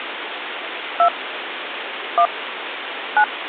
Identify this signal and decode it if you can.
DTMF, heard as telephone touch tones, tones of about 70 ms, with phone line noise. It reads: 2 1 9